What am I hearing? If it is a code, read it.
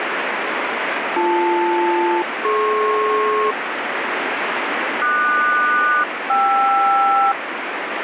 Aircraft SELCAL, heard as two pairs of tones, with radio static. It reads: BL-DP QS-KR